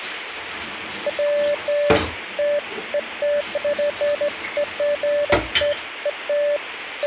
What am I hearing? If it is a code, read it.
Beeps of irregular length, with phone line noise and kitchen noise. There is no code.